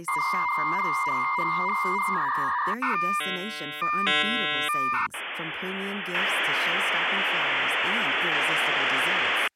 Dial-up modem handshake (V.34 or later), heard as a whistle, warbles, then hiss, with speech in English.